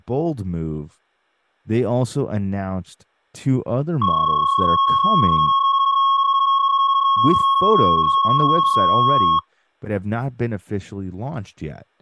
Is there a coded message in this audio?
Yes: PSK31 (31.25 baud) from 4.0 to 9.4 s, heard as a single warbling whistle, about 1090 Hz, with speech in English.